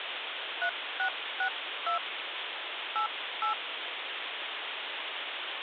DTMF, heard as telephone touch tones, dialled by hand, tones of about 100 ms, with phone line noise. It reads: 3662 88